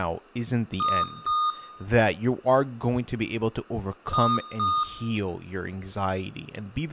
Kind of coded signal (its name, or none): beep code